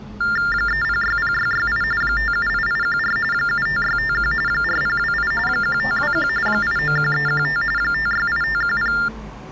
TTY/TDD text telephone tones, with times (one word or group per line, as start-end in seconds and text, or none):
0.5-1.8 3060668
2.0-3.2 578814
3.3-4.3 75651
4.5-5.3 4028
5.5-6.3 1521
6.5-7.6 891315
7.8-8.9 568510